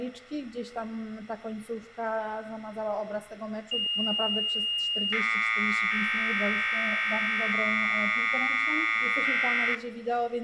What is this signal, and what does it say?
Commodore tape loading (standard loader), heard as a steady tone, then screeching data, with room echo.